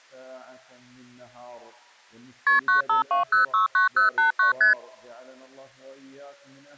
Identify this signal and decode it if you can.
Multi-frequency trunk signalling (R1, as on North American trunks), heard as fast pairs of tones, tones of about 130 ms. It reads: KP 952069089 ST